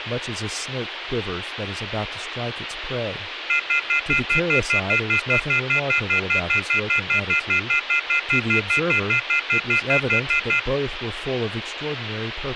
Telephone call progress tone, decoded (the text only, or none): off-hook warning tone